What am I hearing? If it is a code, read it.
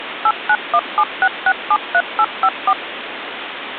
DTMF, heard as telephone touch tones, dialled by machine, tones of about 60 ms, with phone line noise. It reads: 89176673854